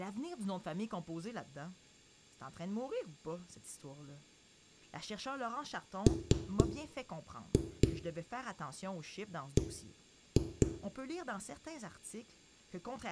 Tap code, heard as knocks on a wall, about 3 knocks a second, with room echo and speech in French. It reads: MB